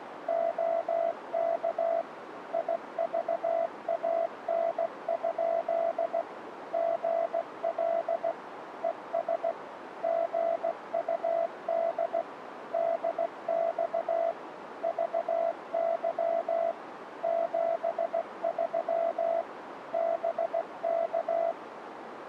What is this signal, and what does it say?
Morse code, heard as a keyed tone, machine-sent, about 16 wpm, 670 Hz, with radio static and a narrow filter. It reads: OK IVAN? GL ES GUD DX VY 73 BK